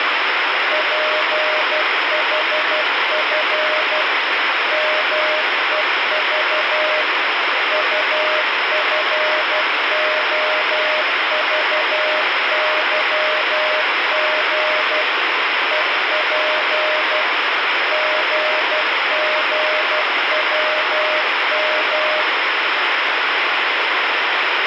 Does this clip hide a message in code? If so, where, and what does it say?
Yes: Morse code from 0.7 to 22.3 s, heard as a keyed tone, machine-sent, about 12 wpm, 620 Hz, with heavy radio static. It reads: PHF MEV UFOVYG EP GGWM